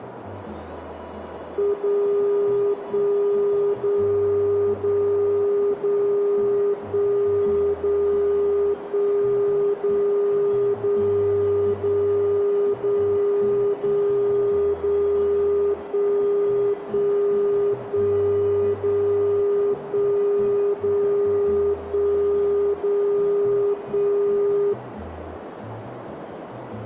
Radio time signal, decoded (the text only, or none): 0 1 0 0 0 1 0 1 0 0 0 0 0 0 1 1 1 0 1 0 1 0 1